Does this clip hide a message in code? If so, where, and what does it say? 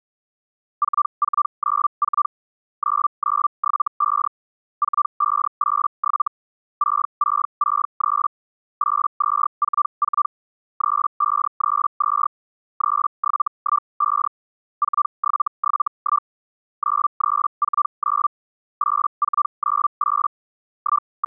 Yes: Hellschreiber (Feld-Hell, 122.5 baud) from 0.8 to 21.3 s, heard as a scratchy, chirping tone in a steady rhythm, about 1180 Hz. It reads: 4494 9975 4587 6663 8244 3532 3715 4771 9349 8498 …